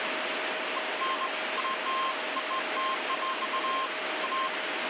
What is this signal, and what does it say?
Beeps of irregular length, with radio static. There is no code.